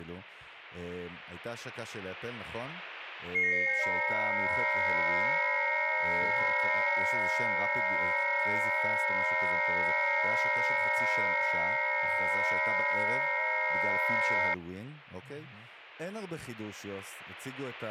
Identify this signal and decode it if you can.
FT8 (several signals at once), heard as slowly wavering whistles, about 6.25 baud, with speech in Hebrew.